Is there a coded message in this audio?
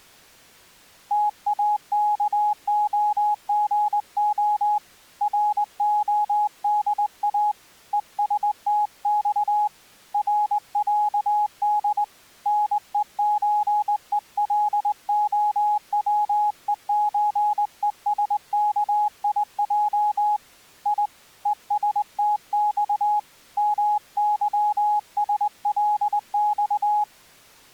Yes: Morse code (Russian alphabet) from 1.1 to 27.1 s, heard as a keyed tone, hand-sent with a straight key, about 20 wpm, 840 Hz. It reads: ТАКОГО РОДА ЕСТЬ РЯД НЕЧЕЛОВЕЧЕСКИЙ И ЕСТЬ МЫСЛЬ